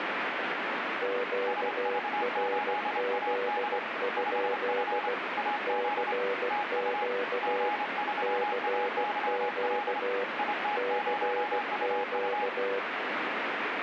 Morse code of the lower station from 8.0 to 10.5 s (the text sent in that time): CQ